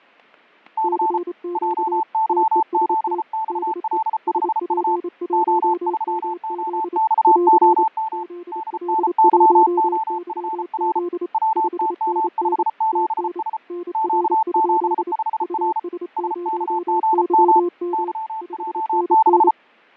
Morse code, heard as two keyed tones, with fading and static crashes. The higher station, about 34 wpm, 880 Hz: C JY7XL5U O3OXOM DNYOFR WTM57S Q75R SKGM YJ6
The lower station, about 28 wpm, 350 Hz: CQ TEST DE SP1MZ <AR> ZL1YZ 5NN TN NR? US0YM 5NN